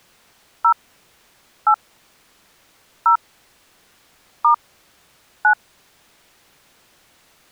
DTMF, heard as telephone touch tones, dialled by hand, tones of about 100 ms. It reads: 0 8 0 * 9